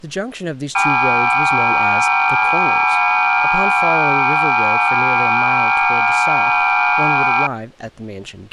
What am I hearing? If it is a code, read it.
FT8 (several signals at once), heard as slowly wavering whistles, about 6.25 baud, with speech in English.